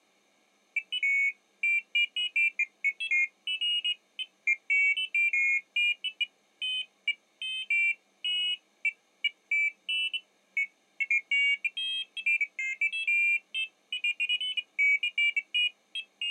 Pairs of high tones at irregular times. There is no code.